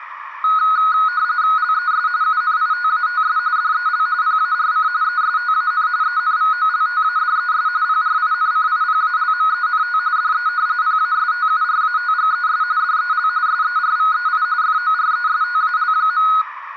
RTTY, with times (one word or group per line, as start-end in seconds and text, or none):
1.6-2.1 LES
2.2-3.4 UNITATS
3.6-4.1 DEL
4.2-4.9 PARC
5.0-5.9 ESTAN
6.0-7.7 ENVOLTADES
7.8-10.0 PRINCIPALMENT
10.2-10.5 DE
10.8-12.6 PASTURATGES
12.8-13.3 DEL
13.5-14.4 SERVEI
14.6-16.3 FORESTAL.